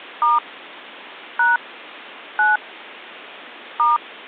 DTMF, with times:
0.2-0.4 *
1.4-1.6 #
2.4-2.6 9
3.8-4.0 *

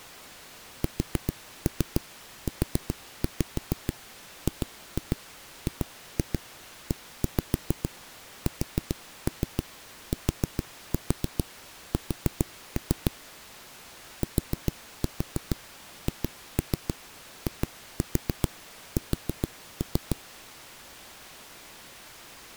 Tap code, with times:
0.8-13.1 SUGGESTS
14.2-20.2 THIS

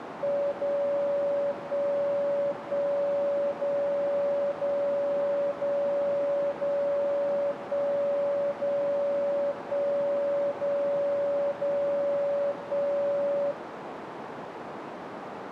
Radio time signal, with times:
0.5-1.5 0
1.5-2.5 1
2.5-3.5 1
3.5-4.5 0
4.5-5.5 0
5.5-6.5 0
6.5-7.5 0
7.5-8.5 1
8.5-9.5 0
9.5-10.5 1
10.5-11.5 0
11.5-12.5 0
12.5-13.5 1

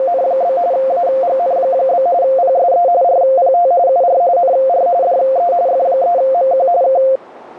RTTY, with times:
0.0-0.6 …
0.7-2.1 AGN?
2.2-2.9 PSE
3.0-3.7 RPT
3.9-4.2 UR
4.4-4.9 NR
5.0-5.5 DE
5.7-6.7 F3MQ
6.8-7.0 K

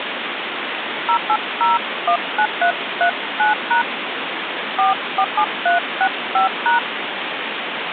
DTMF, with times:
1.1-3.8 08019339#
4.8-6.8 447365#

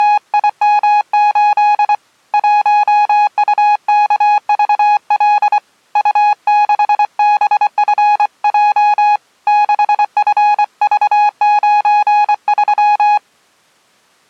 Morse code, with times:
0.0-1.9 …
2.3-5.6 1UKVL
6.0-9.2 U6BFJ
9.5-13.2 6FV93

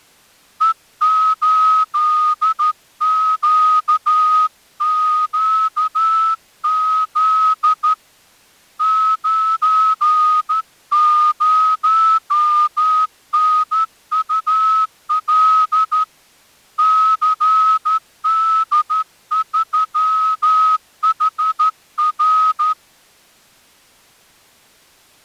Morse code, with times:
0.6-7.9 E8QQZ
8.8-16.0 90NUL
16.8-22.7 CD3HR

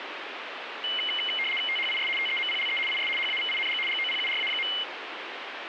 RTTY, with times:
1.7-2.1 THIS
2.2-2.8 TEMPLE
2.9-3.1 IS
3.2-3.8 HAVING
3.9-4.7 GOPURA.

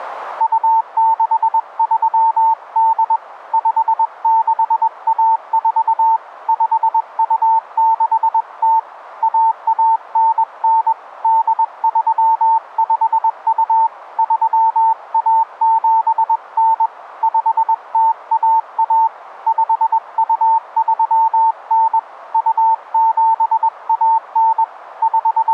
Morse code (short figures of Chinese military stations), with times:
0.4-3.2 2638
3.5-6.2 5614
6.5-8.8 5260
9.2-10.9 1199
11.2-13.9 8352
14.2-16.9 3179
17.2-19.1 5011
19.5-22.0 5239
22.3-24.6 2719
25.0-25.5 …

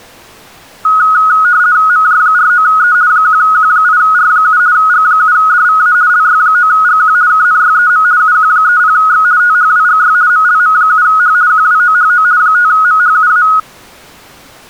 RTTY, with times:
1.9-2.9 MJ49E
3.1-4.6 1Q8R7
4.7-5.9 G7DVA
6.1-7.1 LY9GQ
7.3-8.0 KNYEM
8.2-9.2 UQ30X
9.4-10.1 THWGY
10.3-11.3 MLM7H
11.5-12.2 QWOHO
12.4-13.4 5MHUA

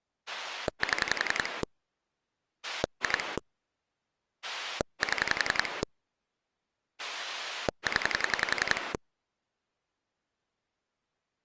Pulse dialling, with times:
0.3-1.6 7
2.6-3.4 2
4.4-5.8 7
7.0-8.9 0

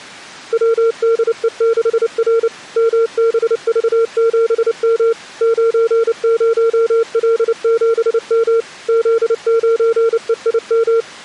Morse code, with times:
0.5-2.5 WDE6R
2.8-5.1 MBV7M
5.4-8.6 90L7M
8.9-11.0 Z9EIM

